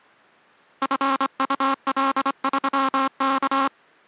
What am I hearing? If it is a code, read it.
Morse code, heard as a buzzer, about 25 wpm. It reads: FUL3K